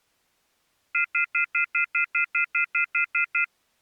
Telephone call progress tone (North American plan), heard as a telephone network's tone, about 1400, 2050, 2450, 2600 Hz, 0.1 s on and 0.1 s off. Off-hook warning tone.